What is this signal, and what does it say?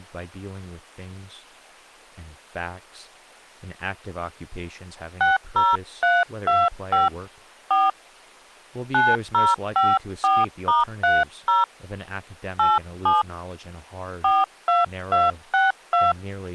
DTMF, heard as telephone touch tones, dialled by hand, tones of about 190 ms, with speech in English. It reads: 60325 4 9054*30 87 42262